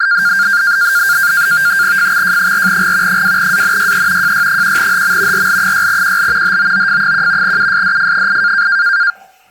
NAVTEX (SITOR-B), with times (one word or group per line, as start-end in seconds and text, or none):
2.0-3.2 FXJ4G
3.1-4.3 2ANYE
4.2-5.5 JY1HM
5.3-6.6 RL6QL
6.4-7.6 HOOF1
7.4-8.7 USDF8